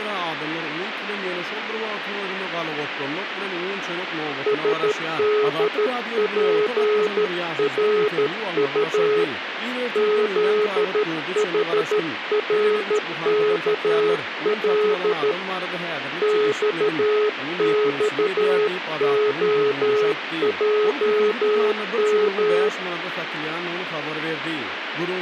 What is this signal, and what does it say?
Morse code, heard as a keyed tone, hand-sent with a paddle, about 13 wpm, 420 Hz, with radio static. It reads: SDPRU ZHRKL XXOJM